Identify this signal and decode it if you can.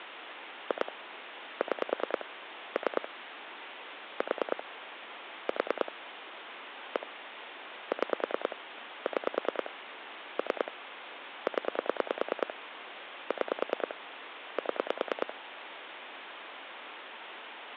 Pulse dialling, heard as clicks on a phone line, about 9 pulses a second, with phone line noise. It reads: 2 6 3 4 4 1 6 6 3 0 6 7